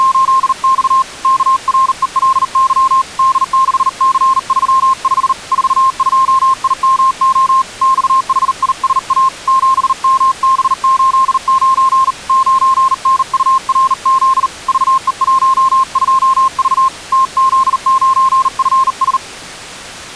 Morse code, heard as a keyed tone, hand-sent with a bug key, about 39 wpm, 1060 Hz. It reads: … KRELY D6C35 42IMO XHISA 7MB89 9NURZ VE12V TZ9FS